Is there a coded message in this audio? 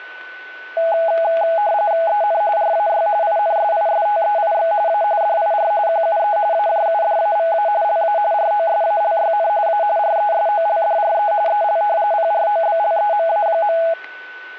Yes: RTTY (45.45 baud, 170 Hz shift) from 0.8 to 13.9 s, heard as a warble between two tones, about 750 Hz centre, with a steady whistle near 1500 Hz. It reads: EN RAY INSISTEIX A DIR QUE AJUDAVA LA ROSALYN A RESOLDRE EL PROBLEMA.